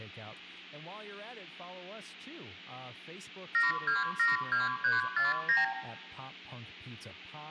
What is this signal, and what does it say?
Multi-frequency trunk signalling (R2, with the far end's replies), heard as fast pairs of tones, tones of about 160 ms, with hum, room echo and speech in English. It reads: 7272349